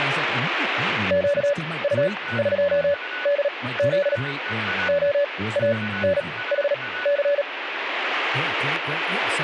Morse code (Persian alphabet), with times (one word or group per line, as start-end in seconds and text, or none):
1.1-4.2 گطقدز
4.9-7.4 عانحث